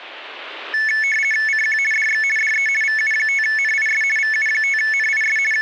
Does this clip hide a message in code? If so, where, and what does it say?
Yes: RTTY (50 baud, 450 Hz shift) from 0.7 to 5.6 s, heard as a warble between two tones, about 2000 Hz centre. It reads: CQ DX DE VU5NIS VU5NIS …